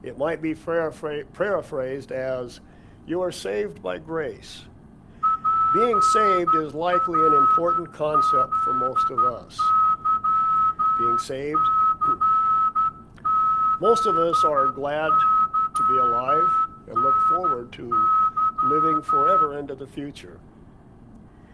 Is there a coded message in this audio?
Yes: Morse code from 5.2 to 19.5 s, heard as a whistle, hand-sent with a straight key, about 12 wpm, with room echo. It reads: PRZYCZYNY